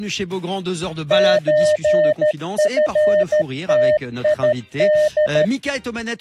Morse code (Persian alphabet), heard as a keyed tone, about 13 wpm, 610 Hz. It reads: چفتید